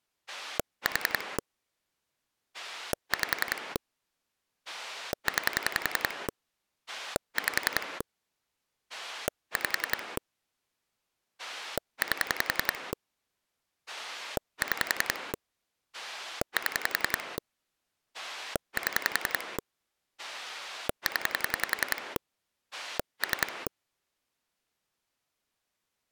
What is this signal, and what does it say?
Pulse dialling, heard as a rotary dial, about 10 pulses a second. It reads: 4 5 9 5 5 8 6 7 7 0 3